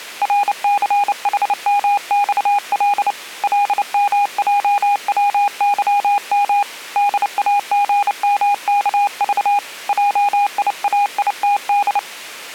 Morse code, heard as a keyed tone, hand-sent with a paddle, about 29 wpm, 820 Hz. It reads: RCHMXL LMJWYM DAGMKV JIAITD